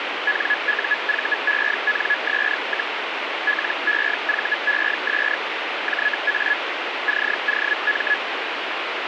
Hellschreiber (Feld-Hell, 122.5 baud), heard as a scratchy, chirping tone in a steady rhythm, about 1700 Hz, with radio static. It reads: NUVENS, LEVES JA COM